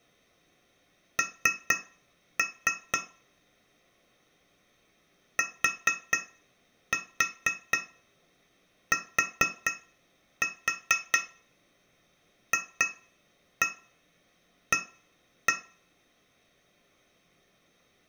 Tap code, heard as taps on glass, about 4 knocks a second, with room echo. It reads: N TTFA